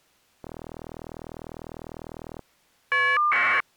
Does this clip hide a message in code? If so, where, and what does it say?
Yes: caller ID data burst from 0.4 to 3.6 s, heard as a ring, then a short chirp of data, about 1200 baud.